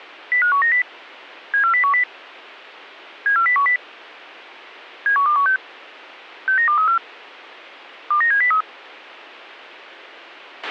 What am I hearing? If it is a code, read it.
Five-tone selective call (CCIR), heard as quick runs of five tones, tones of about 100 ms, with a squelch burst at the end. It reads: 05190 74010 74010 71216 69234 29703